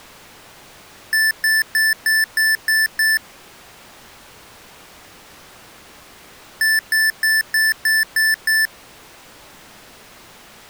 Beep code, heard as beeps from a small speaker, played twice, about 1750 Hz. 7 short. In AMI BIOS tables: virtual mode exception error; in Dell tables: processor failure.